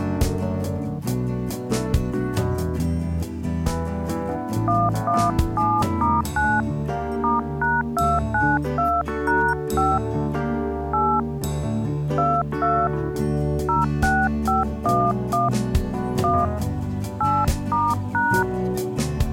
DTMF, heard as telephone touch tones, dialled by hand, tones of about 220 ms. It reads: 117*9 *#292#5 8 22 06511 1 8*#